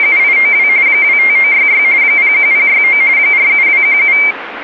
RTTY (45.45 baud, 170 Hz shift), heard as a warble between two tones, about 2200 Hz centre, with radio static. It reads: … 25966 01069 47217